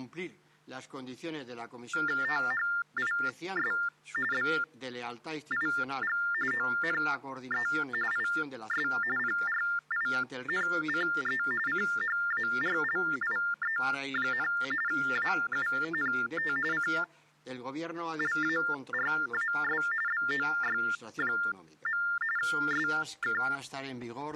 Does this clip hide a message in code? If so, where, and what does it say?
Yes: TTY/TDD text telephone tones (45.45 baud Baudot) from 1.9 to 23.6 s, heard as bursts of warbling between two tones, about 400 Hz shift, 1600 Hz centre. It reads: THIS BIG ONE IS PRINCE CHARLIE, AUNT CLARAS BOY. SK